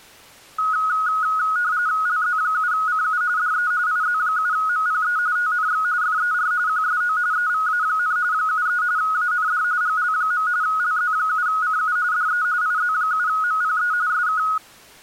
RTTY (45.45 baud, 170 Hz shift), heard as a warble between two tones, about 1360 Hz centre. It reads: LZ7CU DE IZ7MPE TNX FER QSO EVA, 73 AND GL. LZ7CU DE IZ7MPE SK